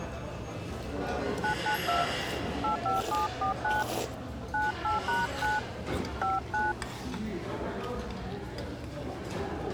DTMF, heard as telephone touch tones, dialled by hand, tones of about 140 ms, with the noise of a restaurant. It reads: 992 85749 98#9 59